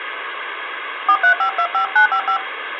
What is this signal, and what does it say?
DTMF, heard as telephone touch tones, dialled by hand, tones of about 90 ms, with phone line noise. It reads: 43525955